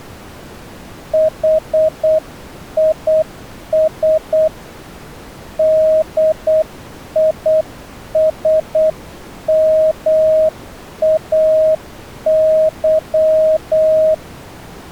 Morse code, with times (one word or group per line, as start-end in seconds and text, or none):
1.1-4.5 HIS
5.6-14.1 DISMAY